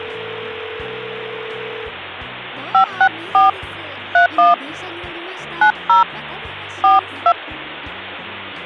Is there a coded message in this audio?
Yes: DTMF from 2.7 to 7.3 s, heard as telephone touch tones, dialled by hand, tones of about 110 ms. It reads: 564 31 90 42